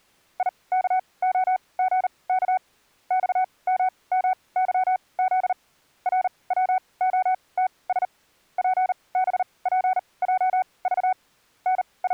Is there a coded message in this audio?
Yes: Morse code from 0.3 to 12.1 s, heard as a keyed tone, machine-sent, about 39 wpm, spaced as for 25 wpm, 750 Hz. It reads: IKOGK XMMYZ RWOTS PBPJV …